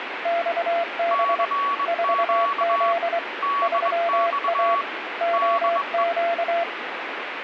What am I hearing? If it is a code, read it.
Morse code, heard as two keyed tones, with radio static. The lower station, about 24 wpm, 680 Hz: XB 4Z 3A OQ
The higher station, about 21 wpm, 1130 Hz: CQ DX DE